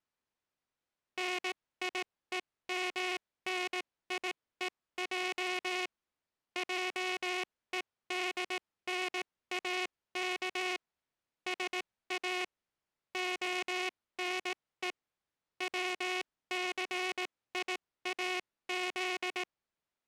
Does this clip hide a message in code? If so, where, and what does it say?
Yes: Morse code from 1.1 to 19.5 s, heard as a buzzer, machine-sent, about 18 wpm, spaced as for 15 wpm. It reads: NIEMNIEJ JEDNAK SA ONE WCIAZ